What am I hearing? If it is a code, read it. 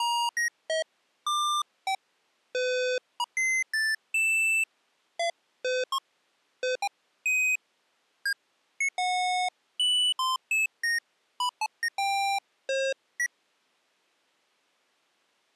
Electronic bleeps of random pitch and length. There is no code.